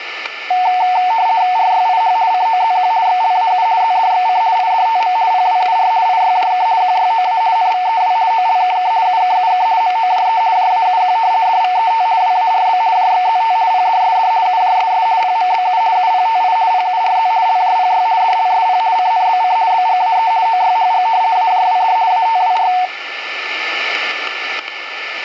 RTTY (50 baud, 170 Hz shift), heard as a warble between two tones, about 820 Hz centre, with static crashes and a steady whistle near 1760 Hz. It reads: RYIH COZQ XLAU ZDXC IDTM PWUR IYJK QYOA NVEW OLKK UKUK MOJE JAUQ DVET WARB JXZT PDSD UJSS PMBU UPTI PURZ LJPY DLSP CNBC BGAE OYHG AJWD ATWR